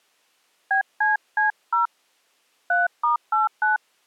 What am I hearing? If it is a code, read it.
DTMF, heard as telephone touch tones, dialled by hand, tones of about 140 ms. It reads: BCC0 3*89